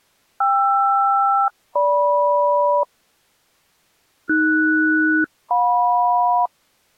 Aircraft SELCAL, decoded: KR-GM AS-JM

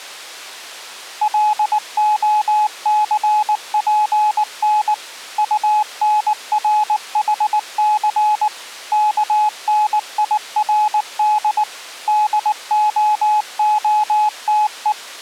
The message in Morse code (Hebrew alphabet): להספן טנרחס כנירד דההתו

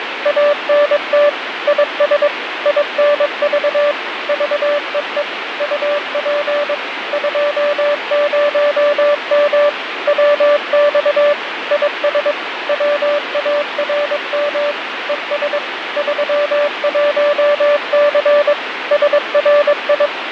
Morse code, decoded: ANT IS INV VEE UP 20M WX IS WARM ES 31C SRI

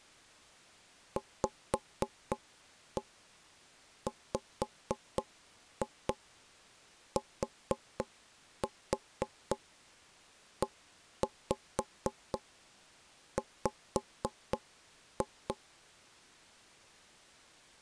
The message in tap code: VWTEW

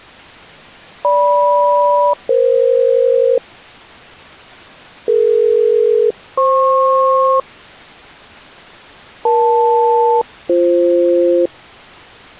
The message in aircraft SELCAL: GM-EF DE-FP EL-BF

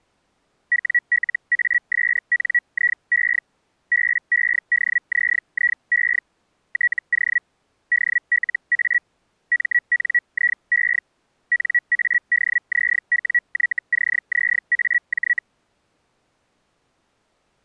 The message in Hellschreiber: WLASNIE BEDZIE TO DLA MNIE NADZWYCZAJ

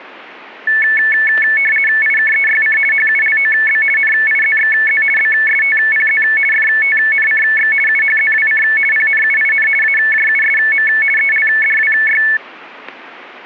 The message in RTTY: IKEYC HULOB NIZXZ BSTPZ FTNCX UHZWC PNUIN AJUSM ELDWY

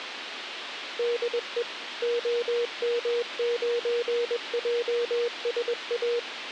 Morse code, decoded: DE OM9JSA

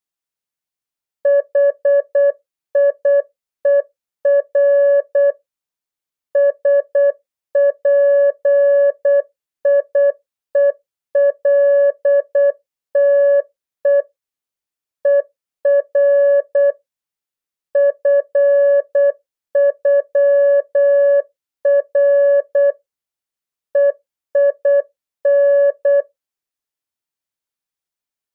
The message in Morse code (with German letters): HIER SPIELTE ER FÜR EIN

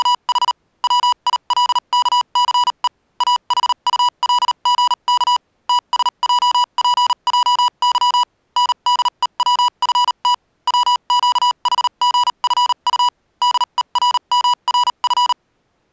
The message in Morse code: … WILKCE AHULGK TSJPJY NDEWFT WQHGFU DERMRF

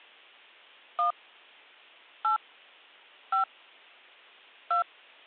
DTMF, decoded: 1 8 5 2

